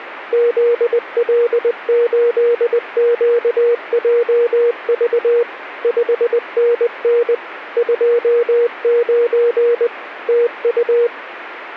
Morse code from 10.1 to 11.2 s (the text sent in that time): TU